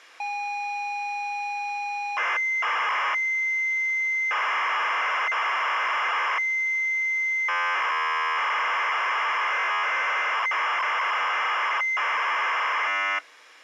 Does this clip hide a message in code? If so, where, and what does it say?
Yes: ZX Spectrum tape loading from 0.2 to 13.2 s, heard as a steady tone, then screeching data.